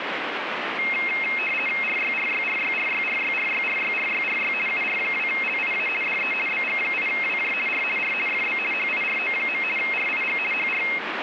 RTTY (50 baud, 450 Hz shift), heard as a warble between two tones, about 2350 Hz centre, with radio static. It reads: RYRYRYRYRYRYRYRYRY UR2LIA DE BG8WJ R R FB HIRO. RIG HR